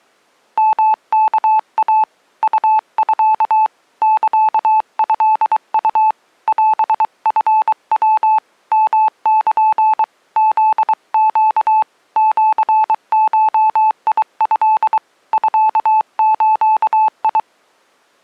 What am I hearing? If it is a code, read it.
Morse code (Japanese Wabun code), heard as a keyed tone, hand-sent with a paddle, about 23 wpm, 870 Hz. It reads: ヨワイ ウミ サトウ オチヤ ヨル フネ シゴト ミズ